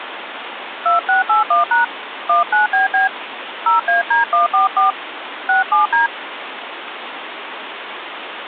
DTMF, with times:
0.9-1.8 2681#
2.3-3.1 19BB
3.7-4.9 0AD144
5.5-6.1 67D

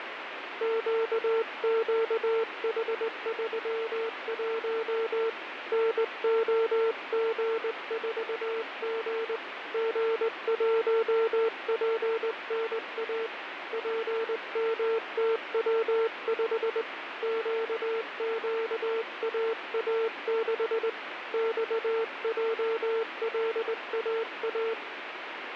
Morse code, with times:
0.6-5.3 QQH31
5.7-9.4 NOG4G
9.7-13.3 G1PNA
13.7-16.8 PMTW5
17.2-20.9 QQAA6
21.3-24.7 XJLAA

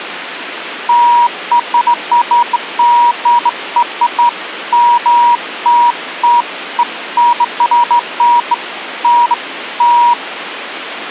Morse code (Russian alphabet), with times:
none

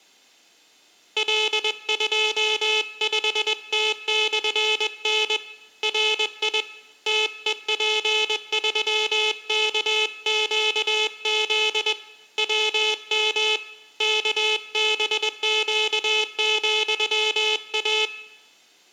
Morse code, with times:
1.2-5.4 L25T/N
5.8-6.6 RI
7.1-11.9 TEP3KQZ
12.4-13.6 WM
14.0-18.1 KBQ,A

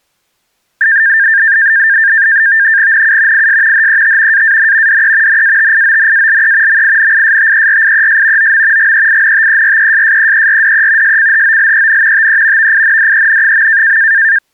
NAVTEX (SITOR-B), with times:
2.9-3.5 NU
3.3-3.9 IS
3.7-4.4 HET
4.3-5.0 AAN
4.9-5.4 DE
5.3-6.8 NATIONALE
6.7-8.5 MINISTERIES
8.4-8.9 OM
8.8-11.2 GEINTERESSEERDE
11.0-12.3 SCHOLEN
12.1-12.7 TE
12.6-14.0 VINDEN.

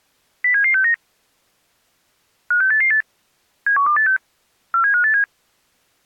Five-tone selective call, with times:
0.4-0.9 07769
2.5-3.0 56888
3.7-4.2 71286
4.7-5.2 47587

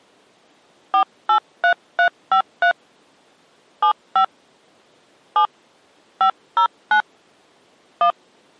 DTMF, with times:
0.9-2.7 483353
3.8-4.2 75
5.4-5.5 7
6.2-7.0 509
8.0-8.1 1

